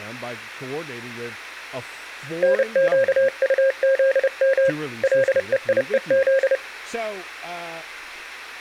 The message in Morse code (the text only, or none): NQUZM LEIEZ